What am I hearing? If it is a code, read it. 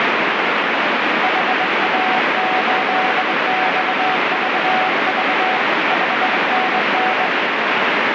Morse code, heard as a keyed tone, hand-sent with a straight key, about 22 wpm, 750 Hz, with heavy radio static. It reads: HA8XVV 5NN